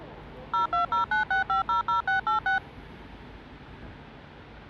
DTMF, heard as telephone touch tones, dialled by machine, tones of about 120 ms, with street noise. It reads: 02096500686